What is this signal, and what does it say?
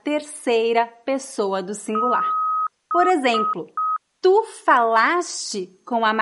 Beep code, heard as beeps, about 1260 Hz, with speech in Portuguese. 1 long, 3 short. In Award and IBM BIOS tables: video adapter failure; in AMI BIOS tables: memory failure.